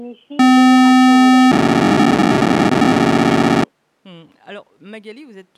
POCSAG pager data (512 baud), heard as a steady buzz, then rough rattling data.